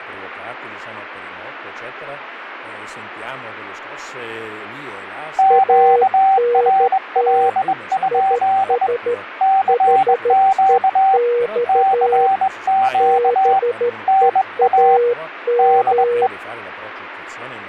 Morse code, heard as two keyed tones, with radio static. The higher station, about 21 wpm, 770 Hz: QRL? CQ CQ NA DE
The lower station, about 13 wpm, 480 Hz: ANT IS HEX BEAM